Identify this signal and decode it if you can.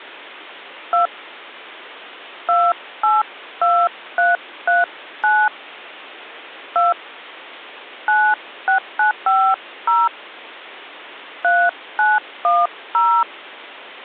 DTMF, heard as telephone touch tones, dialled by hand, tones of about 190 ms. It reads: 2 282339 2 96950 3910